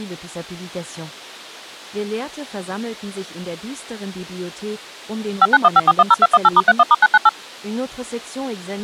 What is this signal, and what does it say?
DTMF, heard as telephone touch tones, dialled by machine, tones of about 40 ms. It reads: 5915410218*31*998